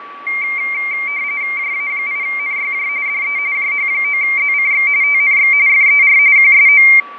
RTTY (45.45 baud, 170 Hz shift), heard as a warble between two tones, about 2200 Hz centre, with fading and a steady whistle near 1140 Hz. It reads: JA8NYJ DE JH9ZCX TNX FER QSO